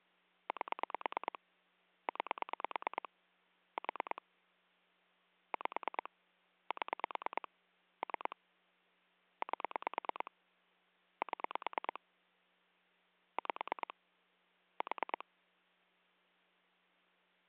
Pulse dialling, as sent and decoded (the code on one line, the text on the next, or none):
8 / 9 / 4 / 5 / 7 / 3 / 8 / 7 / 5 / 4
8 9 4 5 7 3 8 7 5 4